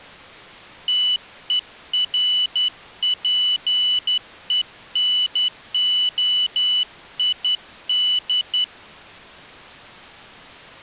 Morse code, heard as a high beeper, hand-sent with a straight key, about 12 wpm, 2950 Hz. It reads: TERPENOID